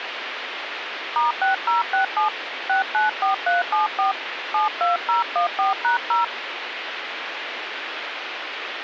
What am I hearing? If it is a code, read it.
DTMF, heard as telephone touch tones, dialled by hand, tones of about 130 ms, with phone line noise. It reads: *6067 694374 72014#0